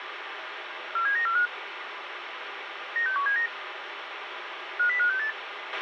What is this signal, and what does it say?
Five-tone selective call (CCIR), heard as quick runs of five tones, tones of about 100 ms, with radio hiss and a squelch burst at the end. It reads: 47945 96179 50568